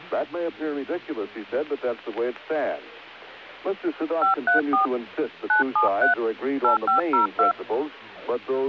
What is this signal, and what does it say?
DTMF, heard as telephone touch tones, dialled by hand, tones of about 120 ms. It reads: 534 973 8502